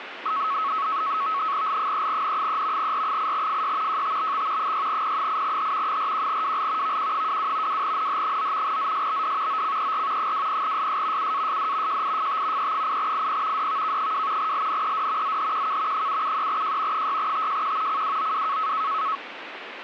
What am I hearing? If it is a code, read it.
NAVTEX (SITOR-B), 100 baud, 170 Hz shift, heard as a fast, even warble, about 1200 Hz centre, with radio static. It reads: L3N3 R8FY JTBX 6P8H 41WL VQ22 2NH9 ZSBD OCER 20SS UASD JIFT E8IP DVK2 LNED ZHQK 773J 6TJQ CWOW